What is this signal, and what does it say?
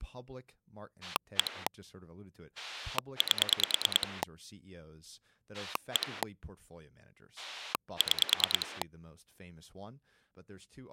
Pulse dialling, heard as a rotary dial, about 9 pulses a second, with speech in English. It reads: 1 8 1 6